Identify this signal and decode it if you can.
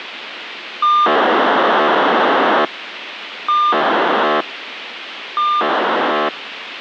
POCSAG pager data (2400 baud), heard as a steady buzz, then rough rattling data, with radio hiss.